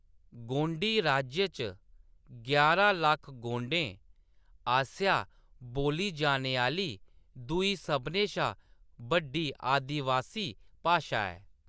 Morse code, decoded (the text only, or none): none